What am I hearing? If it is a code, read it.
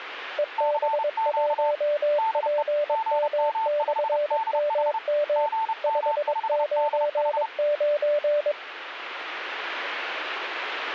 Morse code, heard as two keyed tones. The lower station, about 22 wpm, 590 Hz: EB1PM/MM 599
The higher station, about 30 wpm, 890 Hz: CQ DE GM5DH GM5DH